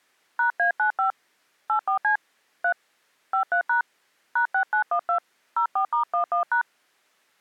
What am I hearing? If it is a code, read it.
DTMF, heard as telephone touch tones, dialled by hand, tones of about 100 ms. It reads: #A95 84C 3 53# #6912 04*11#